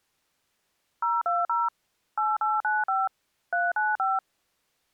DTMF, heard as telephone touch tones, dialled by machine, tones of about 190 ms. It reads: 020 8895 395